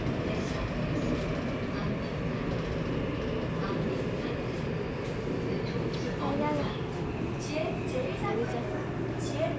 The noise inside a subway train. There is no code.